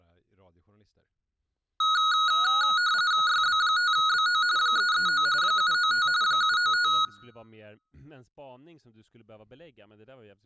RTTY (45.45 baud, 170 Hz shift), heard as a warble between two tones, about 1360 Hz centre, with room echo and speech in Swedish. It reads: YB5BO 339 795 795